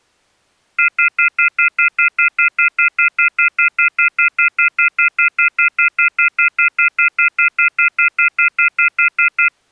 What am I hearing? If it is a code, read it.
Telephone call progress tone (North American plan), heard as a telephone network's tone, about 1400, 2050, 2450, 2600 Hz, 0.1 s on and 0.1 s off. Off-hook warning tone.